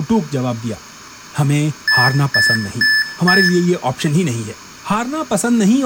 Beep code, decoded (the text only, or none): 4 short